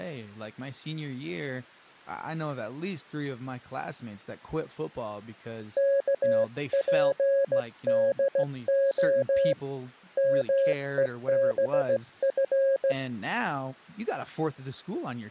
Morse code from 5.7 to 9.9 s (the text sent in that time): KPDO